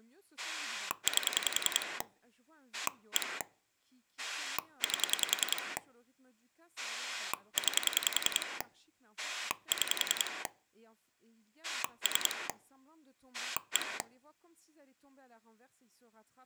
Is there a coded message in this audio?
Yes: pulse dialling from 0.4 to 14.0 s, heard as a rotary dial, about 10 pulses a second, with speech in French. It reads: 8 1 8 9 6 3 1